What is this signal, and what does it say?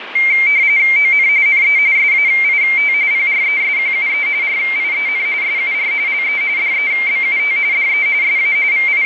RTTY (45.45 baud, 170 Hz shift), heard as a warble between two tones, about 2200 Hz centre, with radio static. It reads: ON NE SAIT PRESQUE RIEN SUR LE DEBUT DE SA …